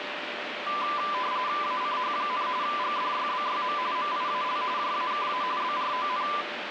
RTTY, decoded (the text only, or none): ACH, GDYBYM MIAL JAKA BRON